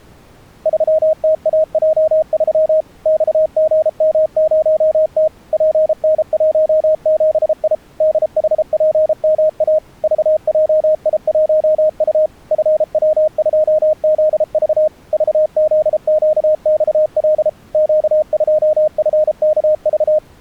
Morse code, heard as a keyed tone, machine-sent, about 33 wpm, 620 Hz. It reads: 3TAJ3 XGM0T PN17I DHPMA VJI1U FW2ZV VZQXL Q2FKV